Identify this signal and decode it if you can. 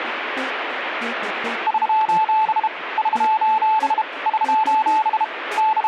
Morse code, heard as a keyed tone, hand-sent with a bug key, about 32 wpm, 870 Hz, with radio static. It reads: <SOS> <SOS> <SOS> …